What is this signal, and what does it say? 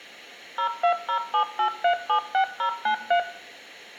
DTMF, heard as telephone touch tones, dialled by machine, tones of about 90 ms, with room echo. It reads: 02078376093